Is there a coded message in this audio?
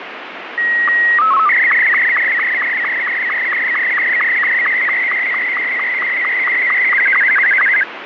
Yes: SSTV (slow-scan television), Martin M2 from 0.6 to 7.8 s, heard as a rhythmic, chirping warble, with radio static.